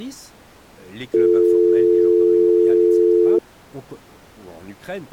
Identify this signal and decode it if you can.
Telephone call progress tone (North American or UK plan), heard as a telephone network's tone, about 350, 440 Hz, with speech in French. Dial tone.